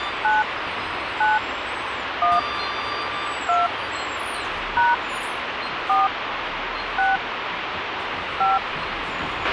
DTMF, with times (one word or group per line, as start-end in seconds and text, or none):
0.2-0.4 9
1.2-1.4 9
2.2-2.4 1
3.5-3.7 2
4.8-4.9 #
5.9-6.1 4
7.0-7.2 6
8.4-8.6 5